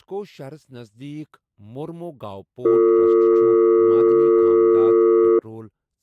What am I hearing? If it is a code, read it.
Telephone call progress tone (North American or UK plan), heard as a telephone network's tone, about 350, 450 Hz, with speech in Kashmiri. Dial tone.